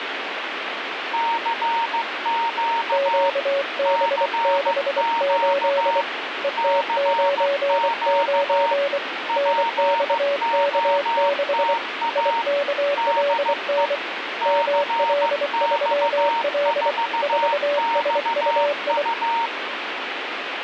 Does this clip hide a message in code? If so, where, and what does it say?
Yes: Morse code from 1.1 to 19.5 s, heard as two keyed tones, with radio static. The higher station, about 15 wpm, 920 Hz: CQ CQ CQ POTA DE CX4XU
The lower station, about 24 wpm, 570 Hz: QB68 ET99 NXK6 IKLN ML3L 4SUI